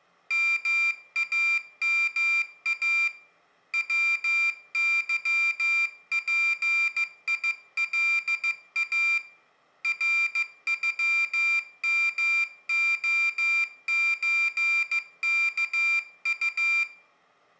Morse code (Russian alphabet), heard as a high beeper, hand-sent with a paddle, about 15 wpm, 2400 Hz, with room echo. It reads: МАМА ВЫПИЛА РЮМОЧКУ